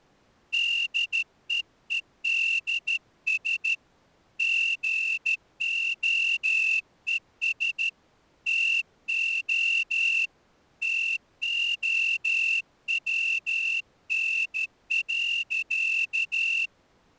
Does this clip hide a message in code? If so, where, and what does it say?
Yes: Morse code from 0.5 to 16.7 s, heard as a whistle, hand-sent with a straight key, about 13 wpm. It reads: DEEDS GOES TO TOWN.